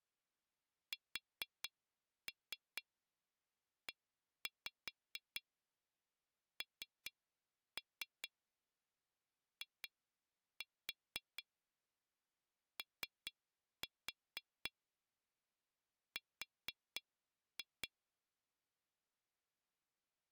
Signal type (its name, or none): tap code